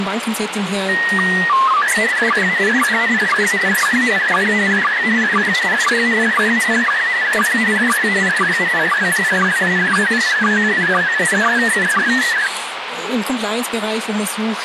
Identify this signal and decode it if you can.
SSTV (slow-scan television), PD 120, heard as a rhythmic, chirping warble, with radio hiss.